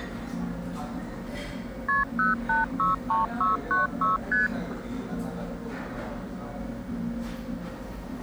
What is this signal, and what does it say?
Multi-frequency trunk signalling (R1, as on North American trunks), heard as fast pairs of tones, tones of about 150 ms, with the noise of a restaurant. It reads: KP 0863696 ST